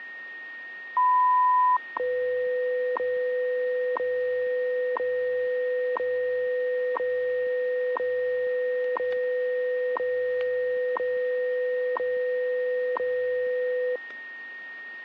Radio time signal (WWV, Colorado), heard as ticks, one a second, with static crashes and a steady whistle near 1860 Hz.